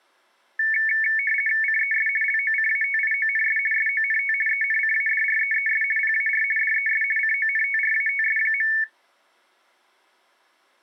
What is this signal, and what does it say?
RTTY (50 baud, 450 Hz shift), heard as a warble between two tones, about 2000 Hz centre. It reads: CES LOCATIONS SONT ENCADREES PAR DES CONTRATS.